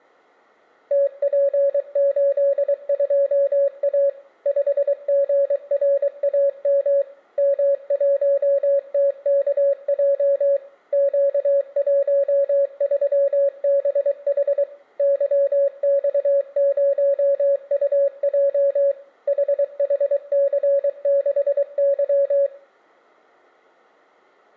Morse code, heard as a keyed tone, machine-sent, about 23 wpm, 560 Hz, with room echo. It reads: TP82A 5GRAM M1TKJ Q13BH YX0UJ HHC6Y